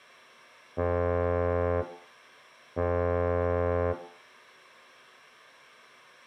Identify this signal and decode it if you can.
Ship horn signal, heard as a ship's horn, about 90 Hz, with room echo. 2 short. At sea: I am altering course to port.